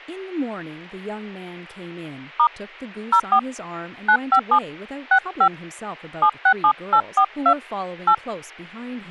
DTMF, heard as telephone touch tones, dialled by hand, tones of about 80 ms, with speech in English. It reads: * 04 957 65 767842 8